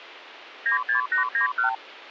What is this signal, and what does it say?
Multi-frequency trunk signalling (R2, with the far end's replies), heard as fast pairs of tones, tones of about 120 ms. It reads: 96891